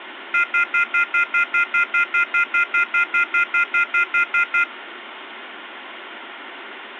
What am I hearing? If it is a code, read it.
Telephone call progress tone (North American plan), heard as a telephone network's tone, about 1400, 2050, 2450, 2600 Hz, 0.1 s on and 0.1 s off, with phone line noise. Off-hook warning tone.